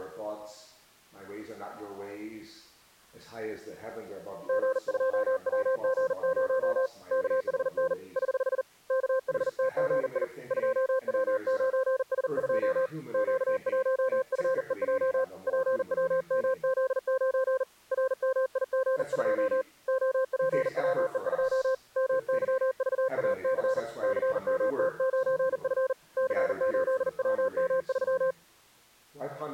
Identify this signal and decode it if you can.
Morse code, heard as a keyed tone, hand-sent with a paddle, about 40 wpm, 520 Hz. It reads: G2WG0 KHN <HH> KHTGI 2W9S2 Q1FEJ PWMZ9 RMIG2 OPWE2 MYVAC CMT9F C8WM3